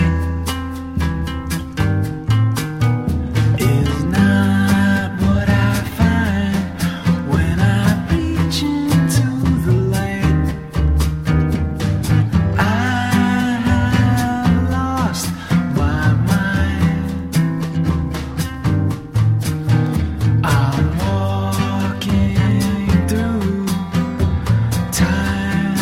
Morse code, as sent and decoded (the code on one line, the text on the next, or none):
none